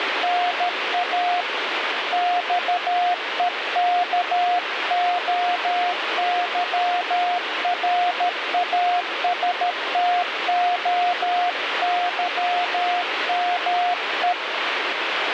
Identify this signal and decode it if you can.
Morse code (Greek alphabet), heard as a keyed tone, hand-sent with a paddle, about 13 wpm, 710 Hz, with radio static. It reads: ΝΑ ΞΕΚΟΥΡΑΣΤΟΥΜΕ